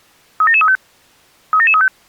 Five-tone selective call (ZVEI), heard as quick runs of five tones, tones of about 70 ms. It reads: 37735 37735